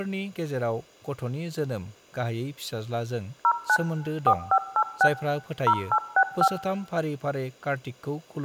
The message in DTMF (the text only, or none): 09 4586 0865